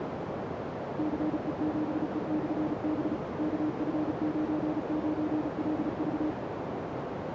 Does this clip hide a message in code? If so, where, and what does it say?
Yes: Morse code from 0.9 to 6.4 s, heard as a keyed tone, machine-sent, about 35 wpm, 310 Hz, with heavy radio static and a narrow filter. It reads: CE7E/B KF99LV